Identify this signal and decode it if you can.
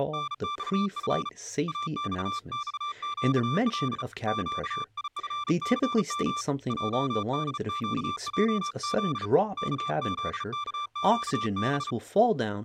Morse code, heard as a keyed tone, hand-sent with a bug key, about 35 wpm, 1180 Hz, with speech in English. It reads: … AXXQL QIFCM JDQJZ KZKQB